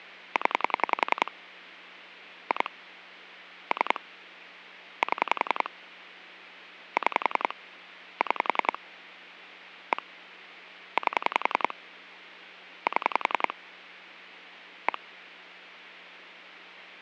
Pulse dialling, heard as clicks on a phone line, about 10 pulses a second. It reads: 0 2 3 7 6 6 1 8 7 1